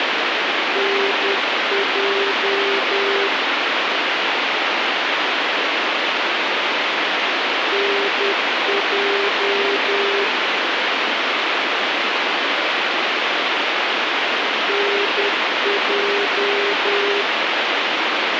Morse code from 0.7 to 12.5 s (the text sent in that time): NJ NJ